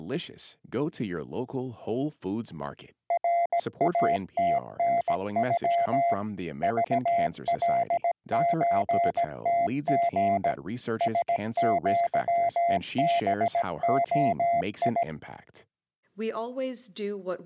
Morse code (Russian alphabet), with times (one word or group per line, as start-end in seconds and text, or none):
3.1-6.1 РАТНЮ
6.6-10.5 ЖЛЧТГ
11.0-15.0 СЪБОИ